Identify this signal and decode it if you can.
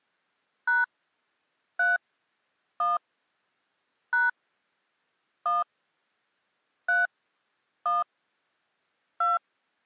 DTMF, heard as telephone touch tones, dialled by hand, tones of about 170 ms. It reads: # 3 1 # 1 3 1 2